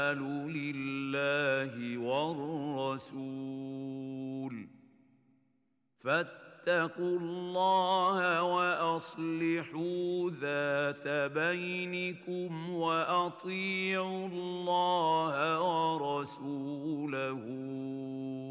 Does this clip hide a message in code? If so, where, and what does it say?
No.